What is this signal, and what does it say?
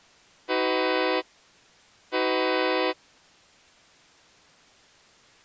Train horn signal, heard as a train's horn. 2 short. On North American railways: a signal is acknowledged.